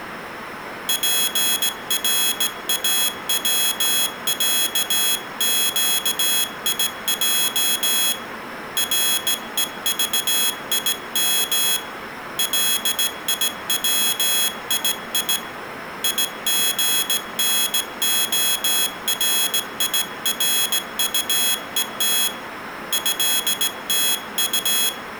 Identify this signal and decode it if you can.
Morse code (Russian alphabet), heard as a high beeper, hand-sent with a straight key, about 17 wpm, 3350 Hz, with room echo. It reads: ПРАВЯЩИЙ РЕЖИМ ЛИВИИ ИГНОРИРУЕТ ЭТУ